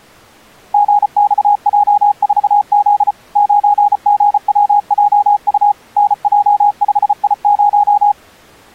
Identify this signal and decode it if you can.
Morse code, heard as a keyed tone, machine-sent, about 34 wpm, 820 Hz. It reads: GXJ4Z 9GWJU NJ5I0